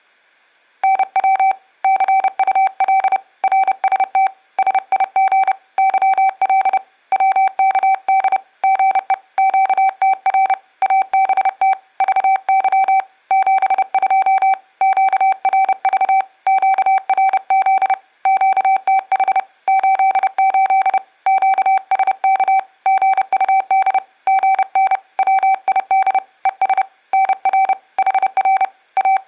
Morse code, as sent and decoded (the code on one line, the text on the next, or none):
-. .-- / -.-. ..- .-.. / .-. ... - / ... .. --. / -.-- .-.. / .-- -.- -.. / --. . / --.- - .-. / .- -... - / ...- -.-- / --... ..--- / --.- .-. ...- / --.- .-. --.. / --.- - .... / ---.. ---.. / --.- ... -.- / --. ..- -.. / --. -. / .-- .. -.. / . ... / -. .-. / .... .-. / …
NW CUL RST SIG YL WKD GE QTR ABT VY 72 QRV QRZ QTH 88 QSK GUD GN WID ES NR HR …